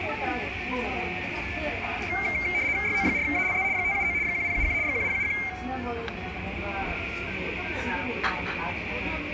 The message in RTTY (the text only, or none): YO4ALZ 579 1071 1071